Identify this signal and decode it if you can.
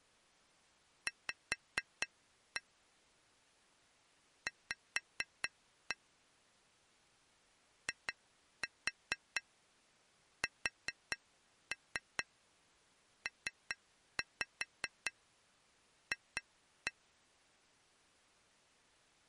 Tap code, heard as taps on glass, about 4 knocks a second. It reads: V V ISPF